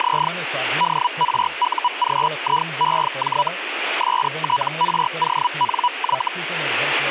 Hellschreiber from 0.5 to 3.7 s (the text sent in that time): DRUGIEJ